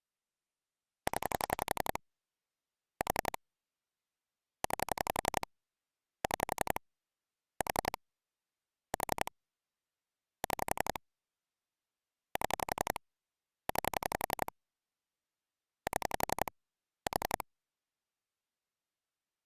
Pulse dialling, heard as clicks on a phone line, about 11 pulses a second. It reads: 0 4 9 6 4 4 6 7 9 7 4